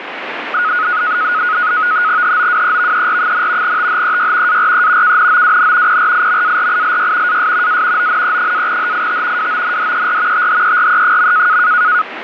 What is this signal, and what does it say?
NAVTEX (SITOR-B), 100 baud, 170 Hz shift, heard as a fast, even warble, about 1360 Hz centre, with radio static. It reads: HOWEVER, THEY ARE KNOWN PRIMARILY AS A ONE-HIT WONDER THERE.